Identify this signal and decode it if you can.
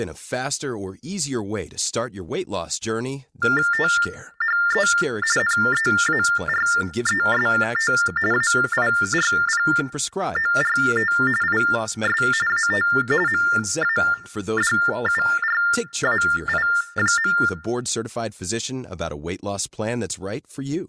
TTY/TDD text telephone tones (45.45 baud Baudot), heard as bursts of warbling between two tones, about 400 Hz shift, 1600 Hz centre, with speech in English. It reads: THE NEAREST AIRPORT IS AT MADURAI.